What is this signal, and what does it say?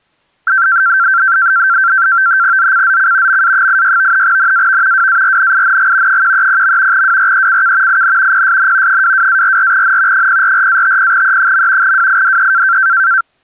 NAVTEX (SITOR-B), 100 baud, 170 Hz shift, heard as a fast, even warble, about 1460 Hz centre. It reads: ZCZC MA86 NAV WARNING 130. WRECK IN PSN 22-44N 044-50E. WIDE